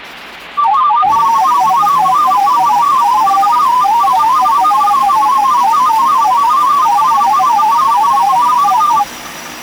Multi-tone FSK (Olivia or MFSK type), about 500 Hz wide, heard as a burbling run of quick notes, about 31.25 baud, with the noise of a restroom.